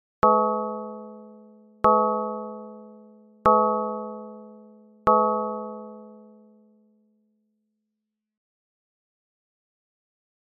Clock strike, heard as a bell. 4. Four o'clock.